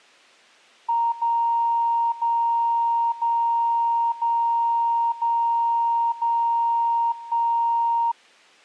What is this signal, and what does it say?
Radio time signal (DCF77), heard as a tone whose level steps once a second, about 930 Hz. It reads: 0 0 0 0 0 0 1